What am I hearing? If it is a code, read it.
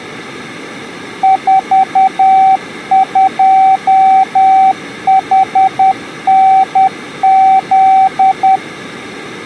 Morse code, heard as a keyed tone, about 10 wpm, 770 Hz. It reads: 42HNZ